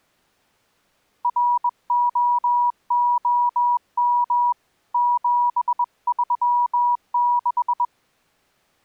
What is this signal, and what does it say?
Morse code, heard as a keyed tone, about 21 wpm, 970 Hz. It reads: ROOM 736